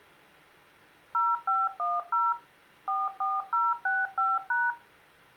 DTMF, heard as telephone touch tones, dialled by machine, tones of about 200 ms, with room echo. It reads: 0510 44065#